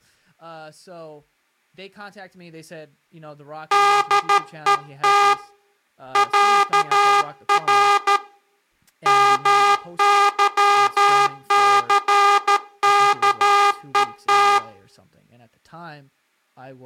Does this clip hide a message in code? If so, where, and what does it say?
Yes: Morse code (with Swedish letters) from 3.7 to 14.6 s, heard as a buzzer, hand-sent with a paddle, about 13 wpm, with room echo and speech in English. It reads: DET ÄR MYCKET